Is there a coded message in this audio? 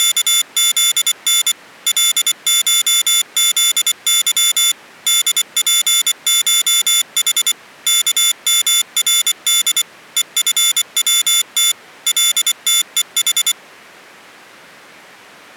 Yes: Morse code (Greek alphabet) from 0.0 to 13.6 s, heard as a high beeper, machine-sent, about 24 wpm, 3500 Hz. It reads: … ΛΧΖΥ ΔΠΧΗ ΚΜΡΔ ΕΦΩΤ ΛΤΕΗ